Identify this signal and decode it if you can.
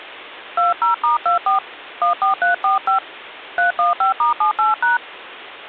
DTMF, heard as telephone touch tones, dialled by hand, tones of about 130 ms. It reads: 20*24 14345 315*78#